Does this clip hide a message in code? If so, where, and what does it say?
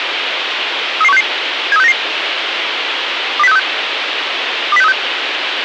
Yes: five-tone selective call (EEA) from 1.0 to 4.9 s, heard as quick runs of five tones, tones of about 40 ms, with radio hiss and a squelch burst at the end. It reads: 33166 73699 20636 20636